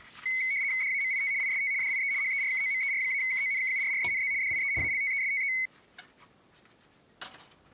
RTTY (75 baud, 170 Hz shift), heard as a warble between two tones, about 2150 Hz centre, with kitchen noise. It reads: DAMIT IST DIE HERKOMER-KONKURRENZ DIE ALTESTE